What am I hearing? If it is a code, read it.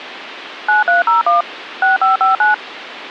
DTMF, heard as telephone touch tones, dialled by machine, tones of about 140 ms, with phone line noise. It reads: 9301 6559